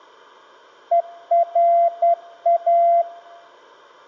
Morse code, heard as a keyed tone, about 11 wpm, 680 Hz. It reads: ERA